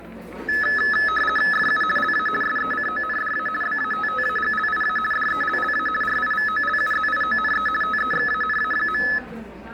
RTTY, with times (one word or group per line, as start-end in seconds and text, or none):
1.5-1.8 FU
2.0-2.3 LA
2.4-3.5 SECONDA
3.6-5.0 BATTAGLIA
5.1-5.9 DELLA
6.0-7.7 RIVOLUZIONE
7.8-9.0 TEXANA.